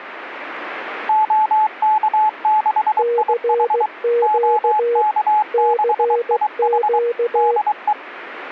Morse code, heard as two keyed tones. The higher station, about 23 wpm, 850 Hz: OK6IH OK6IH DE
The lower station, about 16 wpm, 470 Hz: CQ CQ